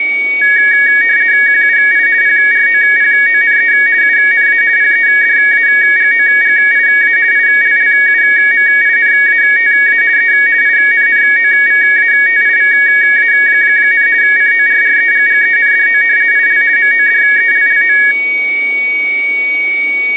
RTTY (50 baud, 170 Hz shift), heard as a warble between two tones, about 1750 Hz centre, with a steady whistle near 2250 Hz. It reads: QUI PROPONE UNA PEDAGOGIA ILLUMINATA E INNOVATIVA, CORREGGENDO IL MODELLO